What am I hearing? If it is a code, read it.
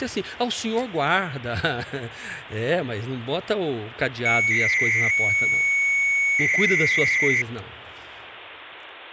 300-baud modem data (Bell 103 tones), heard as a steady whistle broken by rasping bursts, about 300 baud, 200 Hz shift, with speech in Portuguese.